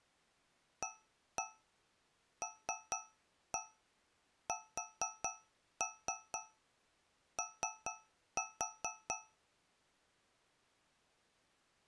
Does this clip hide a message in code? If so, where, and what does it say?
Yes: tap code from 0.8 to 9.5 s, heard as taps on a metal pipe, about 4 knocks a second. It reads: ALSO